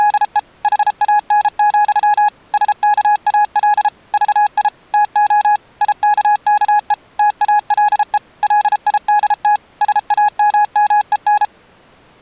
Morse code, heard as a keyed tone, machine-sent, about 33 wpm, 840 Hz. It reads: … HAN, SKAL VI TO IKKE TALE LIDT SAMMEN